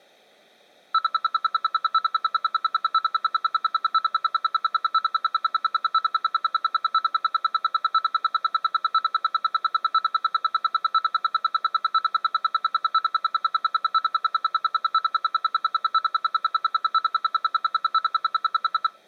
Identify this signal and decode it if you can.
Radio time signal (RWM, Moscow), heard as ten pulses a second.